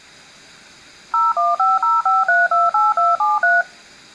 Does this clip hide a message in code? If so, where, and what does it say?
Yes: DTMF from 1.1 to 3.6 s, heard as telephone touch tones, dialled by machine, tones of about 180 ms. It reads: 01505328273